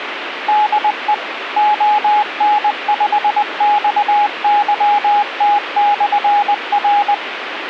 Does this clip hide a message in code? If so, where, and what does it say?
Yes: Morse code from 0.4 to 7.2 s, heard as a keyed tone, machine-sent, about 20 wpm, 830 Hz, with radio hiss. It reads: DE ON5XYT/R